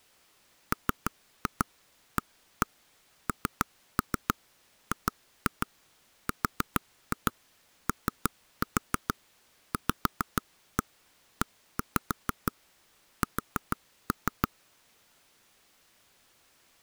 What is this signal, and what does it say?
Tap code, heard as taps on a table, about 6 knocks a second. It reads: MANGROVES